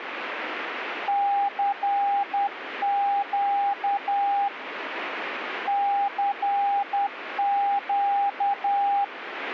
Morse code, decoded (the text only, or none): CQ CQ